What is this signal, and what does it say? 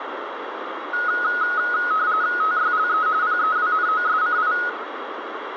RTTY (45.45 baud, 170 Hz shift), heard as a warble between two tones, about 1360 Hz centre, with radio static. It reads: TYLE PEWNOSCI